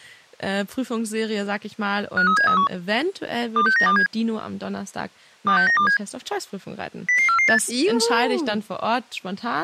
Five-tone selective call (CCIR), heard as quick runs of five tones, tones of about 100 ms, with speech in German. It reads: 53731 26927 26927 00448